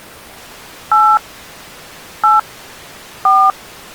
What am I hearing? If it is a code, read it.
DTMF, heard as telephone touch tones, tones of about 220 ms. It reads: 8 8 4